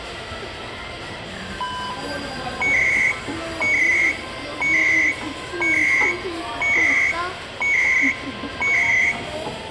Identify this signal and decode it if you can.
Radio time signal (CHU, Canada), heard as beeps and data bursts, one a second, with radio static, room echo and the noise of a cafe.